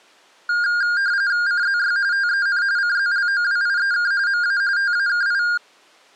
RTTY (45.45 baud, 170 Hz shift), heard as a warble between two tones, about 1500 Hz centre. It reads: CZY TEN CZLOWIEK MA TAKI